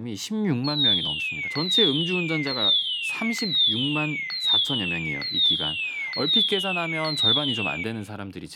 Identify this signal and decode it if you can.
A tone that sweeps in pitch again and again, with room echo and speech in Korean. There is no code.